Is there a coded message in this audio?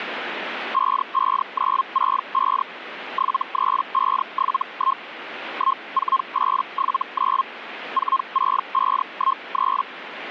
Yes: Hellschreiber (Feld-Hell, 122.5 baud) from 0.7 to 9.8 s, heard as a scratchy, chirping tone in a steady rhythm, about 1070 Hz. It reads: 55965 73571 14879 46513